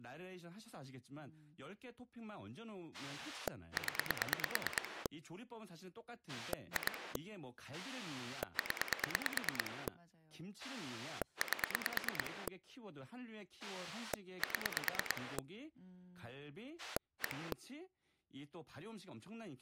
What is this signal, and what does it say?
Pulse dialling, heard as a rotary dial, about 9 pulses a second, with speech in Korean. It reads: 0 2 0 8 7 1